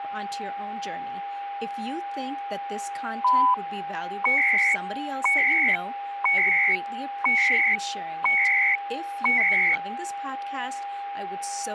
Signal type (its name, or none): radio time signal